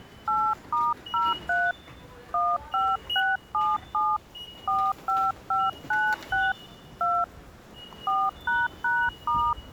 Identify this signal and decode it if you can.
DTMF, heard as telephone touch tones, dialled by hand, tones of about 230 ms, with the noise of a subway station. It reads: 8*03 15677 45596 2 4##*